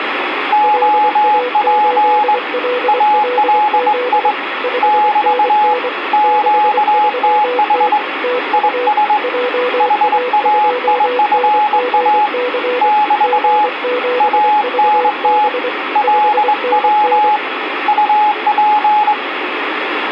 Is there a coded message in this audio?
Yes: Morse code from 0.5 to 19.2 s, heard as two keyed tones, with radio static. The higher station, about 21 wpm, 840 Hz: OP ALI <BT> QTH IS HAIFA <BT> ANT LW UP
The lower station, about 24 wpm, 500 Hz: LA8LLZ 5NN 63T TU JA2NGC G7VB 5NN